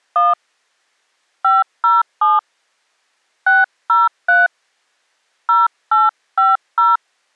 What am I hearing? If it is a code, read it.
DTMF, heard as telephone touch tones, dialled by hand, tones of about 180 ms. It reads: 1 507 603 0850